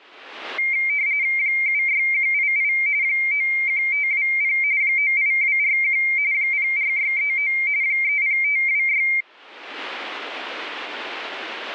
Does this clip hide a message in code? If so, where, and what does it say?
Yes: RTTY (45.45 baud, 170 Hz shift) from 0.6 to 9.2 s, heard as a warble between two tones, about 2200 Hz centre. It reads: 76188 91520 98241 04639 30526